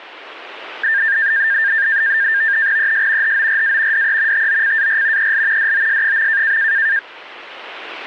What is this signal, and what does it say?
NAVTEX (SITOR-B), 100 baud, 170 Hz shift, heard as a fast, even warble, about 1700 Hz centre. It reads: ES HORA DE TOCAR EL DOS.